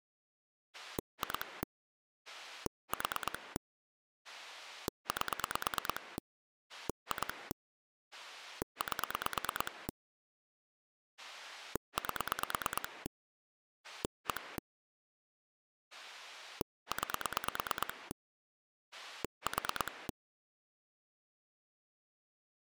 Pulse dialling, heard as a rotary dial, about 9 pulses a second. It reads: 2 4 8 2 8 8 1 9 4